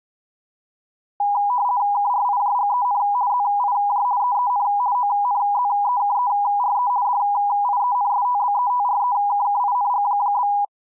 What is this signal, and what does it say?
RTTY (50 baud, 170 Hz shift), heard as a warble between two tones, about 900 Hz centre. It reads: KRIJGEN ZIJ EEN ONZEKERE DIENSTBETREKKING?